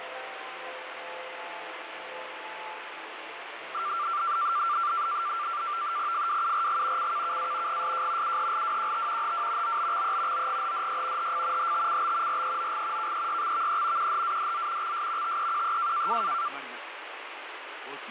NAVTEX (SITOR-B), 100 baud, 170 Hz shift, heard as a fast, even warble, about 1270 Hz centre, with radio static. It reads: FWURG CKKA GSJ UHLWQT HW OBXE OGHDY HF HTCB REOG KEYXVE QHADZ XS TEQE